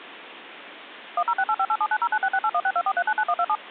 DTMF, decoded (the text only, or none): 10685879096681624399127